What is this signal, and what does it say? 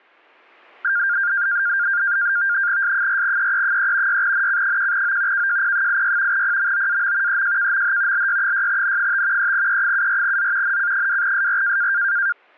NAVTEX (SITOR-B), 100 baud, 170 Hz shift, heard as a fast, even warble, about 1500 Hz centre. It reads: S4EE3 6NC1O KJP86 PMOAM EJKMH LY6N5 3E74Z NC2SR